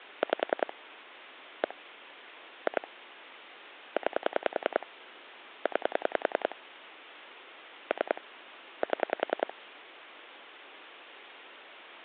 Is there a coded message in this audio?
Yes: pulse dialling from 0.2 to 9.5 s, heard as clicks on a phone line, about 10 pulses a second. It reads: 5 1 2 9 9 3 7